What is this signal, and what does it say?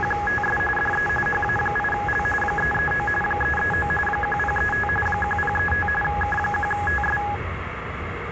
RTTY (45.45 baud, 850 Hz shift), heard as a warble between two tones, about 1250 Hz centre, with radio static and the noise inside a subway train. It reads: … DE HA8L 339 339 1035 1035 K1TS